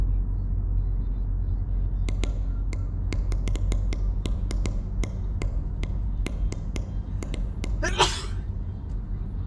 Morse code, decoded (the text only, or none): none